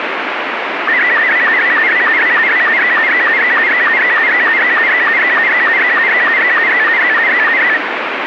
SSTV (slow-scan television), Robot 72, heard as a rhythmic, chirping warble, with radio static.